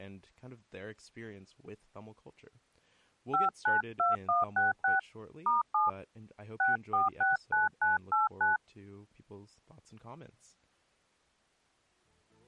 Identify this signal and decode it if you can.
DTMF, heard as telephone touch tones, dialled by hand, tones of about 160 ms. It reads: 592166 *7 6469989